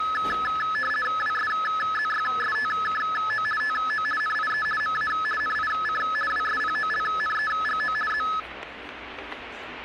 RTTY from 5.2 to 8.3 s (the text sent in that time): NIC WSPOLNEGO Z